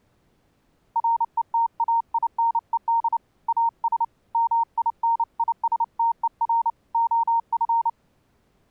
Morse code, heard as a keyed tone, hand-sent with a paddle, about 29 wpm, 920 Hz. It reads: RETAINED AS MINISTER OF